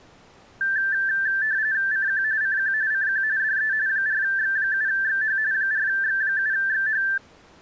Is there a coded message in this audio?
Yes: RTTY (45.45 baud, 170 Hz shift) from 0.6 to 7.2 s, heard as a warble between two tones, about 1650 Hz centre. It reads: CQ CQ CQ DE 4X7XH 4X7XH